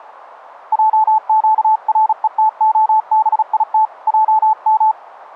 Morse code (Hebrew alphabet), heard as a keyed tone, hand-sent with a paddle, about 36 wpm, 870 Hz. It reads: עקרותהבית עם